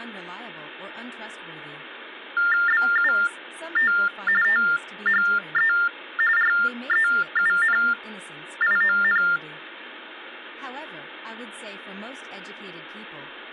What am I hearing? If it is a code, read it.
TTY/TDD text telephone tones (45.45 baud Baudot), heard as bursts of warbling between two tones, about 400 Hz shift, 1600 Hz centre, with phone line noise and speech in English. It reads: BUT THE REUNION